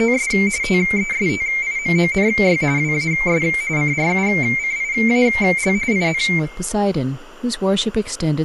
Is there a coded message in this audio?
Yes: RTTY (45.45 baud, 170 Hz shift) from 0.0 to 6.4 s, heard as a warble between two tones, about 2200 Hz centre, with room echo and speech in English. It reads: … TESTIMONY WAS CRUCIAL IN